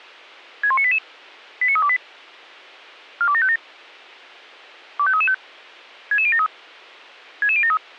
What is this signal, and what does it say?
Five-tone selective call (ZVEI), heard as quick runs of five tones, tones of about 70 ms. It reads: 61988 89328 42757 25335 66073 66073